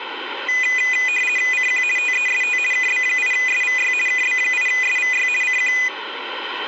RTTY (50 baud, 450 Hz shift), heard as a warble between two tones, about 2250 Hz centre, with radio static. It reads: CQ TEST KB8SVY KB8SVY CQ